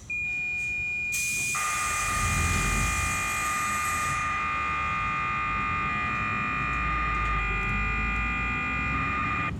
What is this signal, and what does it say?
Cassette data (Kansas City type), 1200 baud, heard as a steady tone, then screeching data, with the noise inside a bus.